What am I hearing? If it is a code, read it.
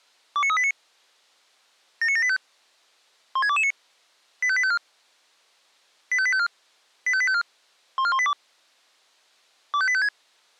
Five-tone selective call (ZVEI), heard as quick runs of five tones, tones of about 70 ms. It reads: 29389 79785 16229 85854 85854 85854 14182 25856